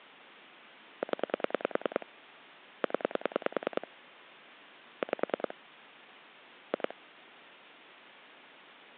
Pulse dialling, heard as clicks on a phone line, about 10 pulses a second. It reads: 0 0 5 2